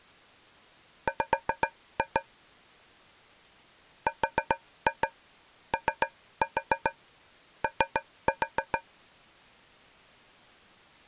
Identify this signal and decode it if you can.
Tap code, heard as taps on a metal pipe, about 7 knocks a second. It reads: W ROO